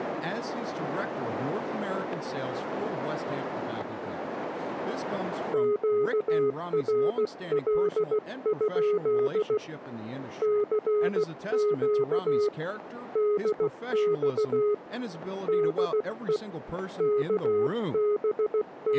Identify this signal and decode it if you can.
Morse code, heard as a keyed tone, hand-sent with a paddle, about 16 wpm, 420 Hz, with static crashes and speech in English. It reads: QRL? CQ DX DE …